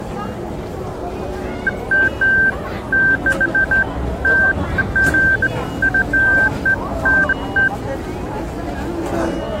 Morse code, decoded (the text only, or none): none